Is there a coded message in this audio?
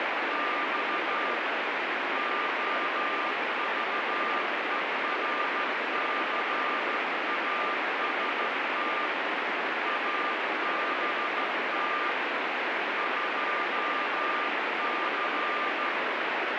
Yes: Morse code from 0.0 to 16.0 s, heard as a keyed tone, hand-sent with a straight key, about 14 wpm, 1200 Hz, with heavy radio static. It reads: … OVERCAST ABT 2C